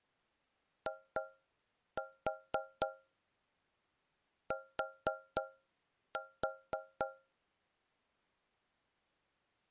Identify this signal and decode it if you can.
Tap code, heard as taps on a metal pipe, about 4 knocks a second. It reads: IT